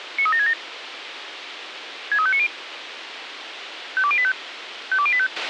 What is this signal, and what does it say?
Five-tone selective call (ZVEI), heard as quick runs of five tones, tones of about 70 ms, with radio hiss and a squelch burst at the end. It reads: 93767 63590 52085 52085